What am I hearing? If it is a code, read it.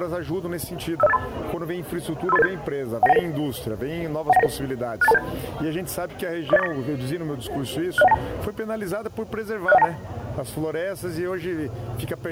Five-tone selective call (EIA), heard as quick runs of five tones, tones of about 30 ms. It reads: 50583 53887 19199 19199 68227 40849 60192 60192